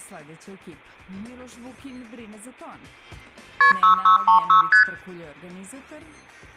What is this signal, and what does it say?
Multi-frequency trunk signalling (R1, as on North American trunks), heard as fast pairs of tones, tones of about 120 ms, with room echo. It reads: KP 6636 ST